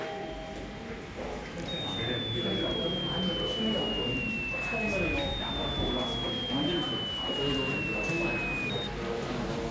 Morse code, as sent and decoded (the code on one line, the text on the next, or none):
none